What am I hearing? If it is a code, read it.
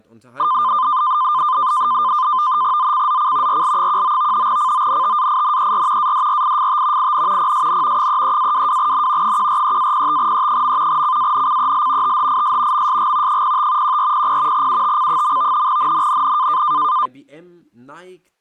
NAVTEX (SITOR-B), 100 baud, 170 Hz shift, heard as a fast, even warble, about 1120 Hz centre, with speech in German. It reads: ZCZC RL19 CONTAINER ADRIFT IN PSN 33-22N 143-05E. CANCEL THIS MSG 05 1400 UTC. NNNN